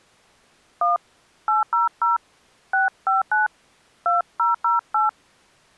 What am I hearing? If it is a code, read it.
DTMF, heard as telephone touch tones, dialled by hand, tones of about 150 ms. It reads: 1 800 659 2008